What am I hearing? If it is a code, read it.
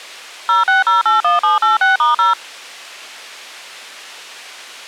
DTMF, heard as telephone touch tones, dialled by machine, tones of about 150 ms. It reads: 06081786*0